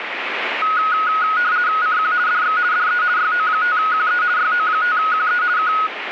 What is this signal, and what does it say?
RTTY (50 baud, 170 Hz shift), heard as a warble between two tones, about 1360 Hz centre, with radio static. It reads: CQ DX DE YO5QE YO5QE K